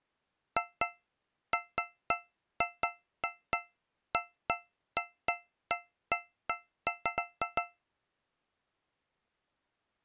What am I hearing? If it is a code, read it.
Irregular taps on a metal pipe. There is no code.